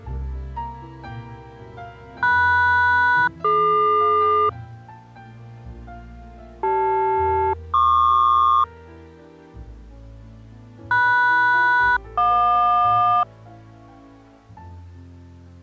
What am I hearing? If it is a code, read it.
Aircraft SELCAL, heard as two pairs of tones. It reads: MS-DQ CL-PQ MS-JQ